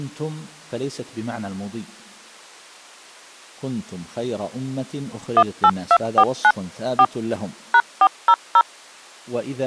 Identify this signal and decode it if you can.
DTMF, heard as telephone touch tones, dialled by machine, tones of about 60 ms. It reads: 18249 4 #400